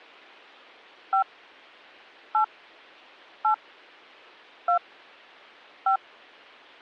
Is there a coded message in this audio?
Yes: DTMF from 1.1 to 6.0 s, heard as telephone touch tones, dialled by hand, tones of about 100 ms. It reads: 5 8 8 2 5